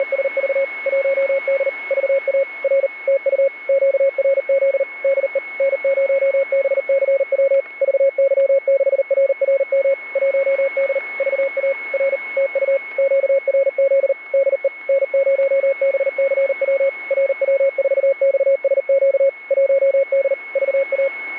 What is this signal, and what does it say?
Morse code, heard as a keyed tone, machine-sent, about 39 wpm, 550 Hz, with a steady whistle near 2190 Hz. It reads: … 1D VA R TU QRZ DE N0BCW VY6RRM 1D VA R TU QRZ DE N0BCW RW4XSQ 1D VA